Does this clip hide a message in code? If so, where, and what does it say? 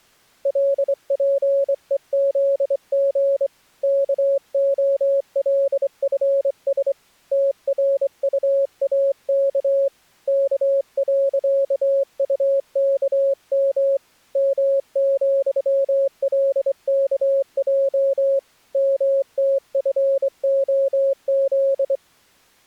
Yes: Morse code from 0.4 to 22.0 s, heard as a keyed tone, hand-sent with a straight key, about 24 wpm, 550 Hz. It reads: LPEZG KOLFS TRUAK K.UKM M,LKJ MTFOZ